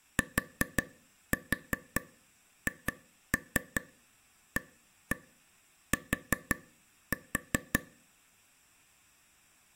Tap code, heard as taps on a table, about 5 knocks a second. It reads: THAT